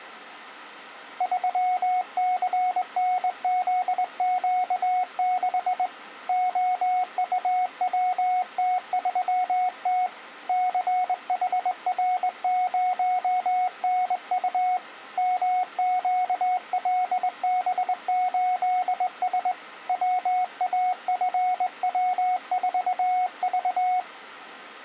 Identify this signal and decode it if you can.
Morse code, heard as a keyed tone, hand-sent with a straight key, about 21 wpm, 730 Hz. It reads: 3CNZQ6 OUWT3T CHR0NU MQLB8S WAFW4V